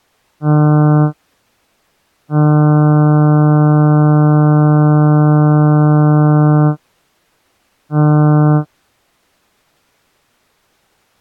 Ship horn signal, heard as a ship's horn, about 150 Hz. 1 short, 1 long, 1 short. At sea: a vessel at anchor warns of its position.